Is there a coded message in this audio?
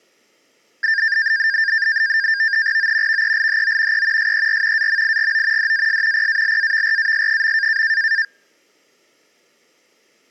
Yes: NAVTEX (SITOR-B), 100 baud, 170 Hz shift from 0.8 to 8.2 s, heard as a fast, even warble, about 1700 Hz centre. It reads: O VELHO E SER AMIGO DAS PALAVRAS.